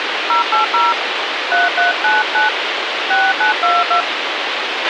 DTMF, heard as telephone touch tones, dialled by hand, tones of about 160 ms, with radio hiss and a squelch burst at the end. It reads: 080 3399 6922